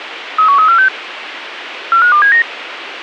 Five-tone selective call (CCIR), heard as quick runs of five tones, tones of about 100 ms, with radio hiss. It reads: 31346 45279